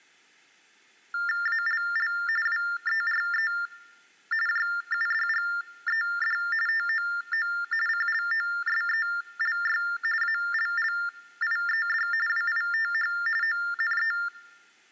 TTY/TDD text telephone tones (45.45 baud Baudot), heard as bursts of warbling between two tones, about 400 Hz shift, 1600 Hz centre. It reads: ALL WERE JUDGED TOO CLOSELY ALLIED WITH ONE